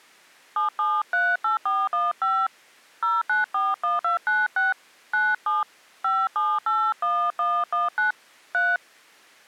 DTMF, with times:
0.6-2.5 7738415
3.0-4.7 0941296
5.1-5.6 97
6.0-8.1 5781119
8.5-8.8 3

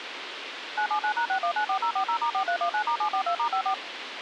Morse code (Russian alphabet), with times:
none

